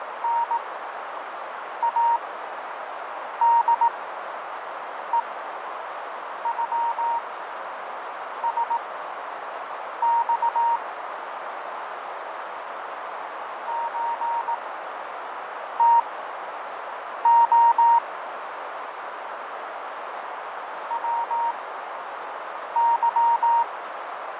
Morse code (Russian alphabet), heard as a keyed tone, machine-sent, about 18 wpm, spaced as for 6 wpm, 930 Hz, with heavy radio static, fading and a narrow filter. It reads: НАДЕЮСЬ ЧТО ВЫ